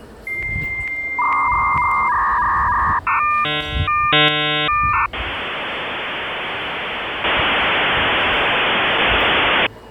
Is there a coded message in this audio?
Yes: dial-up modem handshake (V.34 or later) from 0.3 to 9.7 s, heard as a whistle, warbles, then hiss, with the noise of a crowd indoors.